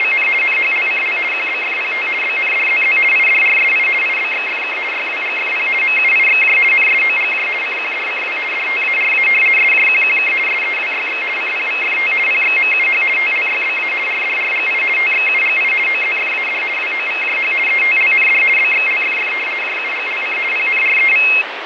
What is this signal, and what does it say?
RTTY (50 baud, 450 Hz shift), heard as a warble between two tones, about 2350 Hz centre, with radio static and fading. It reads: … NHLCL QBFPT BNDZZ IDRSI IBXFK YWGFP MUIXJ NSOGJ CQDCW DTARA SJQQK SEWYX CPVFT PXMUH TLYBA RDRGI TXUGI OZFAD WOVJH ETLND BXLFF JUGLC PNREV